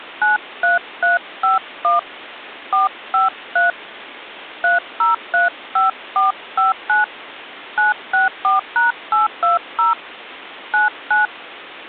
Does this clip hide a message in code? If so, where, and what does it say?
Yes: DTMF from 0.2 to 11.3 s, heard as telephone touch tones, dialled by hand, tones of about 150 ms. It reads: 93351 453 3035459 964#820 99